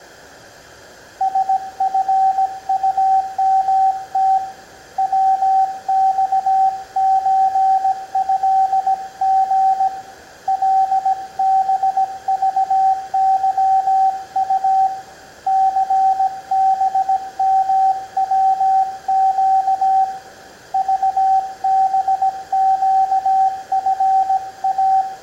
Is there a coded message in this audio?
Yes: Morse code (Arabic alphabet) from 1.1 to 25.1 s, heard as a keyed tone, hand-sent with a paddle, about 17 wpm, 770 Hz, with room echo. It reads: سفطمت وصزهغ لبضظط ثبموق ضبقفا